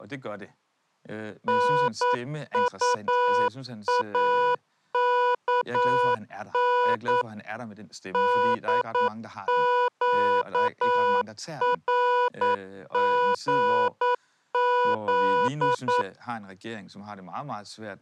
Morse code, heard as electronic beeps, machine-sent, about 9 wpm, 490 Hz, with speech in Danish. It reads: NUAKN DQRGZ